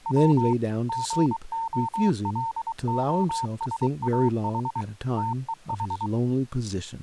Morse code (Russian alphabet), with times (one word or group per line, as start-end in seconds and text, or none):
0.1-0.5 В
0.9-4.8 ГОЛОСАХ
5.2-6.1 ТЕХ